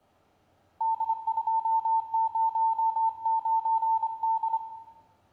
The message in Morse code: D209D

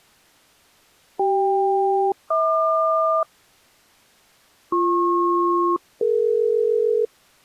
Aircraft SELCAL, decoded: CK-HQ BP-DE

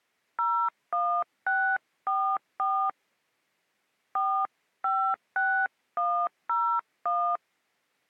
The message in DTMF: 01644 456101

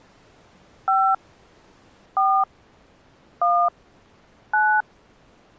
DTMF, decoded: 5 4 1 9

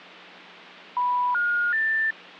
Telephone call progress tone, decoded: special information tone

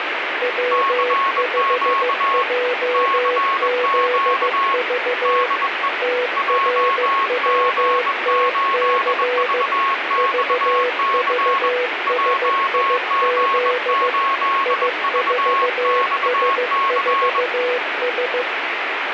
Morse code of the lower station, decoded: W5JZV TRWTC VVSIZ I4S4S

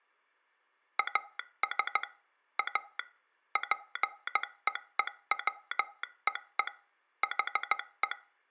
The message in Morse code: AS A PEEWEE HE

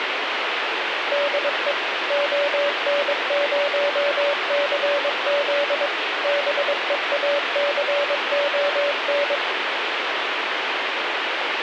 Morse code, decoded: DE ON0CZ BEACON

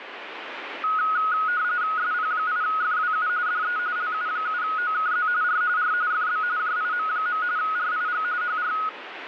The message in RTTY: SP8FWU DE LU7OKZ R R FB JIM. RIG HR

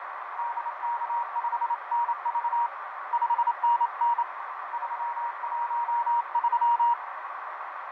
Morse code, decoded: DK5NV 5NN 313

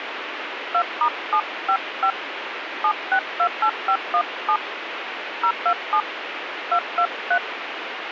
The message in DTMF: 2*755 7628517 027 223

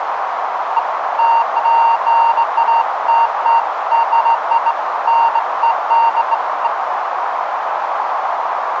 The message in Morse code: none

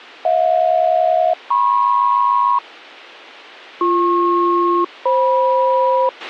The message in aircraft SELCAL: HJ-MP BP-FM

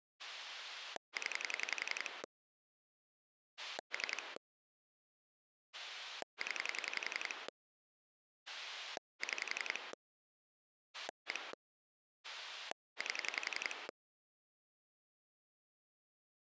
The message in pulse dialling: 0 3 0 6 1 8

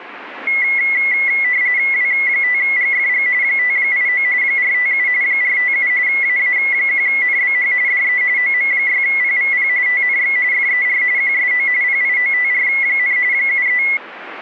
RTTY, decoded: W5GFG 589 457 457 AA1NBH DE OM6PVP TNX FER QSO PIOTR, 73

